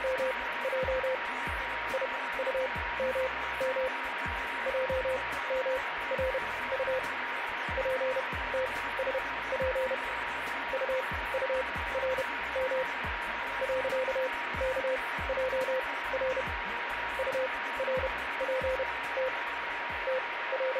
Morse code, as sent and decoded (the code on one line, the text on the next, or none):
… / .. ..- -- -- / .--- -- .-. ..- / .--. - ... .--. / ..- ..- .-. -- / .-.-.- -.- .--- .-. / ..- .-. .--. - / …
… IUMM JMRU PTSP UURM .KJR URPT …